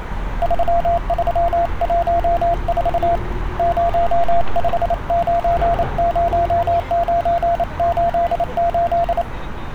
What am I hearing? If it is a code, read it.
Morse code, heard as a keyed tone, hand-sent with a paddle, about 28 wpm, 690 Hz, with street noise. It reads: 3314 0590988